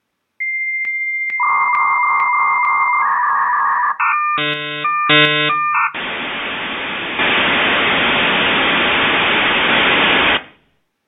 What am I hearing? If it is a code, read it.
Dial-up modem handshake (V.34 or later), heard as a whistle, warbles, then hiss, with room echo.